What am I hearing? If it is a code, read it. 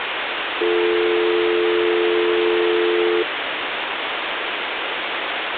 Telephone call progress tone (North American or UK plan), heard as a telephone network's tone, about 350, 440 Hz, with phone line noise. Dial tone.